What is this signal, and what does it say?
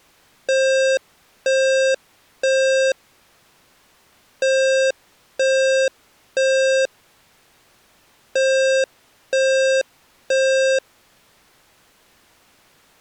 Alarm pattern, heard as an alarm's beeps, played three times, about 530 Hz. Temporal three. Smoke or fire, evacuate.